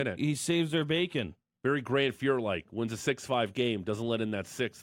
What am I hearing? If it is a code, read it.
Speech in English. There is no code.